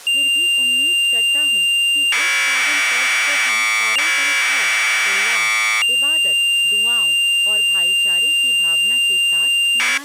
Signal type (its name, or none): Commodore tape loading